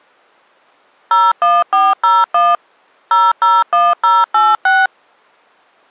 DTMF, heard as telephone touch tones, dialled by machine, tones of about 210 ms. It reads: 01401 001086